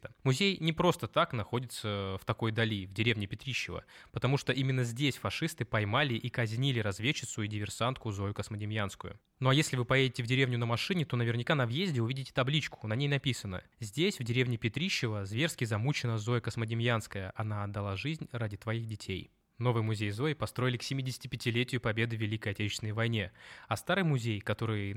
Speech in Russian. There is no code.